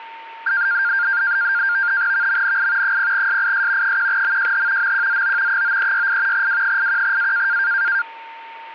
NAVTEX (SITOR-B), 100 baud, 170 Hz shift, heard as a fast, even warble, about 1500 Hz centre, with static crashes and a steady whistle near 910 Hz. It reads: VMNI 0SIS 1MJH MQZO 9368 W81A